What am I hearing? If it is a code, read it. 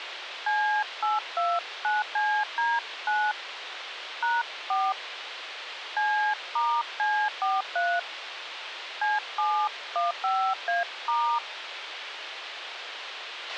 DTMF, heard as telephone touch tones, dialled by hand, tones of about 260 ms, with radio hiss and a squelch burst at the end. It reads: C829CD9 #4 C*C43 C715A*